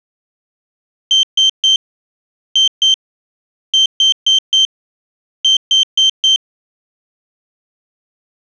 Beep code, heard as a piezo beeper, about 3150 Hz. 3-2-4-4.